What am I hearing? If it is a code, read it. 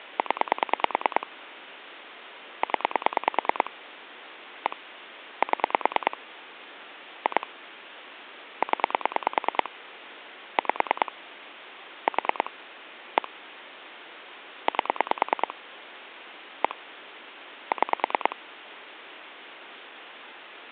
Pulse dialling, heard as clicks on a phone line, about 9 pulses a second, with phone line noise. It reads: 0 0 1 7 2 0 5 4 1 8 1 6